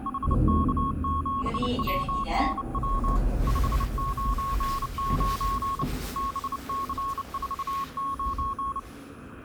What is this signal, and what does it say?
Morse code, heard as a keyed tone, hand-sent with a bug key, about 29 wpm, 1100 Hz, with the noise inside a lift. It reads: HK7WNW 599 BC49